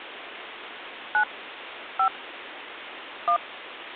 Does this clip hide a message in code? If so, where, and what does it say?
Yes: DTMF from 1.1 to 3.4 s, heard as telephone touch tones, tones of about 90 ms, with phone line noise. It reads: 9 5 1